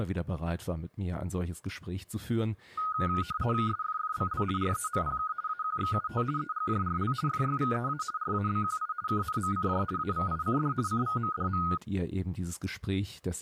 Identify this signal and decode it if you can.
RTTY (50 baud, 170 Hz shift), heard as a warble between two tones, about 1350 Hz centre, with speech in German. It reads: SFFBL REMPK AQXUT EGJRL FYVEA RABQI KNMCJ AVICD CVMDM